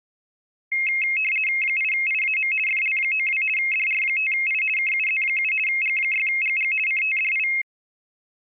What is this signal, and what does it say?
RTTY (50 baud, 450 Hz shift), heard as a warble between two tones, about 2350 Hz centre. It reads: 8IAM FL92 DR5I KUZ7 G6GG CTDI